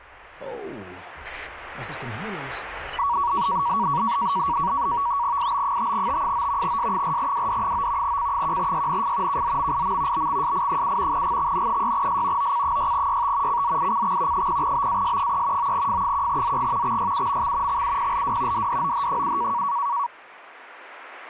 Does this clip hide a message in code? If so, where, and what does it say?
Yes: NAVTEX (SITOR-B), 100 baud, 170 Hz shift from 3.0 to 20.1 s, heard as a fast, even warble, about 1040 Hz centre. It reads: IB5T9 S4WD9 C1YNF KZMIM BXSI7 GXN6S OC6YT CZICX 0BAS3 9F1ZG XYUMX XUPLW DDOH7